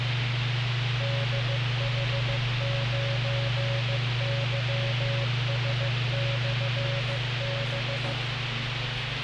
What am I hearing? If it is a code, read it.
Morse code, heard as a keyed tone, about 15 wpm, 560 Hz, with radio hiss, a squelch burst at the end and the noise inside a lift. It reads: DH9YS/B